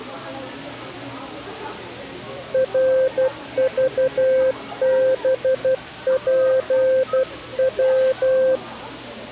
Morse code, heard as a keyed tone, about 12 wpm, 520 Hz, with the noise of a crowd indoors. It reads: RVBPW